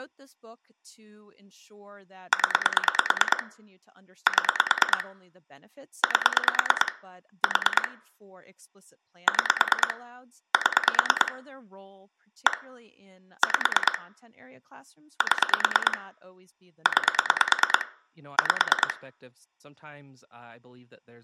Pulse dialling, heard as clicks on a phone line, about 9 pulses a second, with room echo and speech in English. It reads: 0 7 8 4 6 7 1 5 7 9 5